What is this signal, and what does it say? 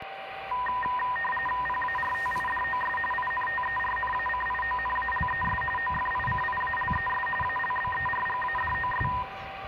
RTTY (45.45 baud, 850 Hz shift), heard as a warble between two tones, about 1420 Hz centre, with radio static, a steady whistle near 780 Hz, room echo and the noise of a residential street. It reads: PARTIDOS INTERNACIONALES OFICIALES ALBERGADOS